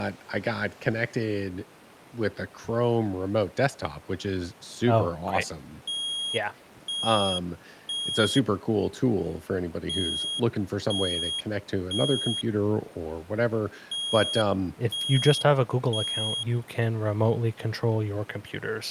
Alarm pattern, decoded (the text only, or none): temporal three